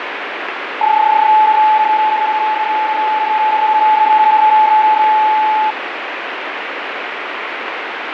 PSK31 (31.25 baud), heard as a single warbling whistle, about 860 Hz, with radio static.